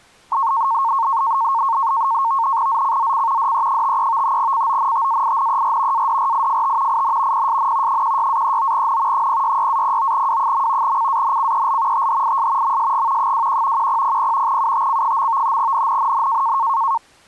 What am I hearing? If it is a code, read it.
NAVTEX (SITOR-B), 100 baud, 170 Hz shift, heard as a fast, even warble, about 1000 Hz centre. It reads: ZCZC DE53 CONTAINER ADRIFT IN PSN 16-39N 066-09W. CANCEL THIS MSG 21 1000 UTC. NNNN